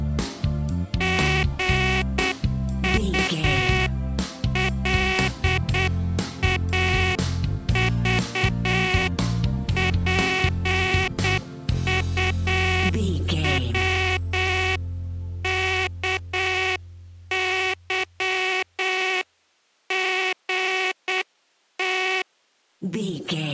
Morse code (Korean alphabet), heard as a buzzer, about 8 wpm. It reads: 시골집에서